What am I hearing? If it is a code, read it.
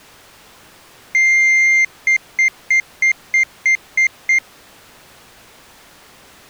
Beep code, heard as a piezo beeper, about 2100 Hz. 1 long, 8 short. In AMI BIOS tables: display or retrace test failure.